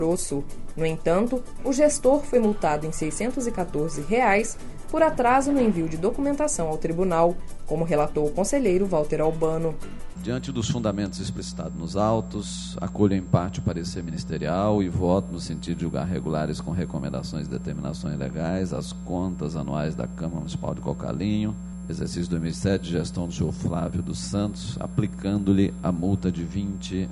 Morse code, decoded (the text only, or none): none